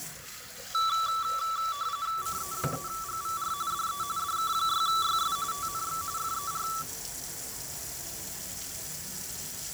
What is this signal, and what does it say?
RTTY (45.45 baud, 170 Hz shift), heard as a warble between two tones, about 1230 Hz centre, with fading and kitchen noise. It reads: CE3GVR DE DK6YS TNX FER